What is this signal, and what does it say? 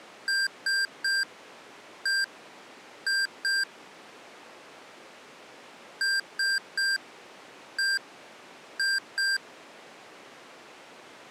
Beep code, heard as beeps from a small speaker, played twice, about 1600 Hz. 3-1-2. In Phoenix BIOS tables: DMA register failure.